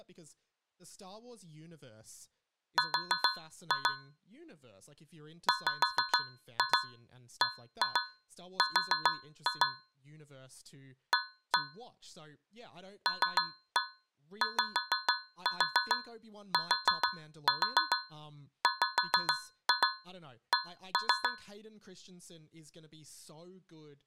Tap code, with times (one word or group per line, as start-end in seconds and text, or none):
2.8-3.9 R
5.5-9.7 WBR
11.1-11.6 A
13.1-21.3 LYTWC